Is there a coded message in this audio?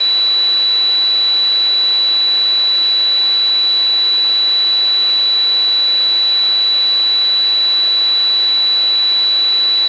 No, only a steady tone.